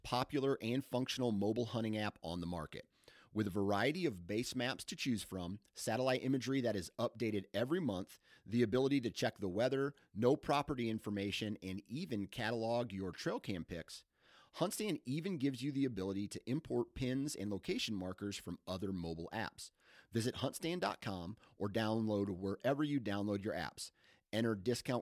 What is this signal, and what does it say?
Speech in English. There is no code.